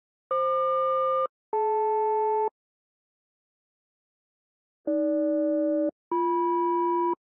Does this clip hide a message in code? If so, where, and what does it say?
Yes: aircraft SELCAL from 0.3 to 7.1 s, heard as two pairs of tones. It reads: FQ-DL AG-BM